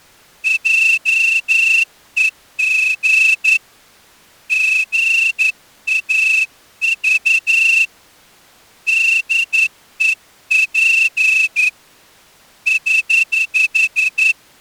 Morse code, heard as a whistle, hand-sent with a straight key, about 11 wpm. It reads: JEG GAV DEP <HH>